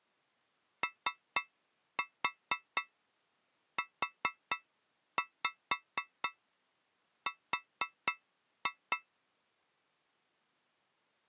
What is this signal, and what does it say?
Tap code, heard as taps on a metal pipe, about 4 knocks a second. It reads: OUR